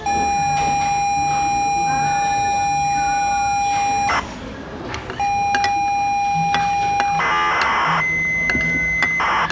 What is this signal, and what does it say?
ZX Spectrum tape loading, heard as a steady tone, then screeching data, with the noise of a restaurant.